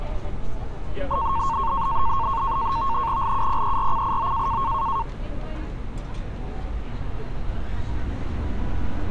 NAVTEX (SITOR-B), 100 baud, 170 Hz shift, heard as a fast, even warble, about 1000 Hz centre, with street noise. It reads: LUPERCIO